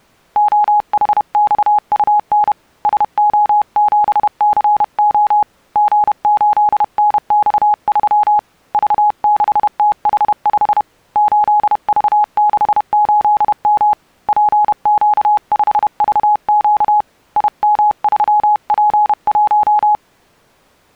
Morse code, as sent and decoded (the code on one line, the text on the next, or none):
--- .... -..- ..- -. / ... --- --... -.-. --- / --. ---.. -. -..- ...-- / ...- -.... - .... ..... / ---.. ...- -.... ---.. -- / .--. --.- ..... ...- --.- / .. -- ...-- .--. .----
OHXUN SO7CO G8NX3 V6TH5 8V68M PQ5VQ IM3P1